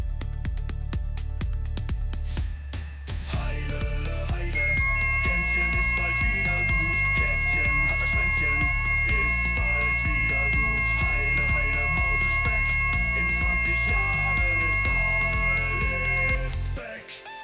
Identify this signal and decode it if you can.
FT8 (several signals at once), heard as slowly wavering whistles, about 6.25 baud, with room echo.